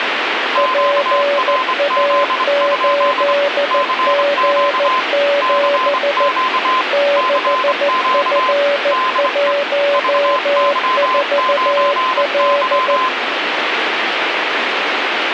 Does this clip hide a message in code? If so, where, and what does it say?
Yes: Morse code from 0.5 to 13.1 s, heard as two keyed tones, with radio static. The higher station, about 25 wpm, 1030 Hz: QRZ? CQ CQ CQ DE VY9Y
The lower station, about 14 wpm, 570 Hz: PA8G7 6F14L